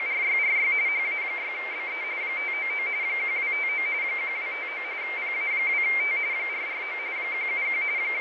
RTTY (45.45 baud, 170 Hz shift), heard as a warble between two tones, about 2200 Hz centre, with radio static and fading. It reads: … HA6BE 599 1259 1259 PA2T 449 171 …